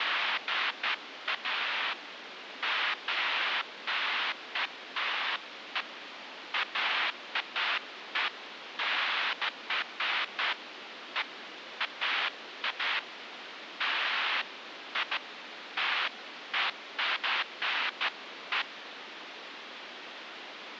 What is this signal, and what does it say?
Bursts of noise, with phone line noise. There is no code.